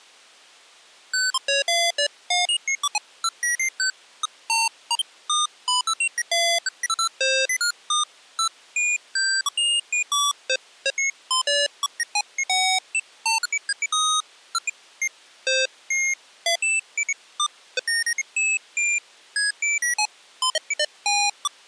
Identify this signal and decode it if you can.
Electronic bleeps of random pitch and length. There is no code.